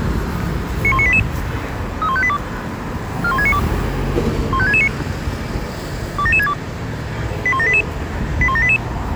Five-tone selective call (ZVEI), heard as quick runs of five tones, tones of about 70 ms, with street noise. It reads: 91988 31582 41692 15669 27762 81788 81788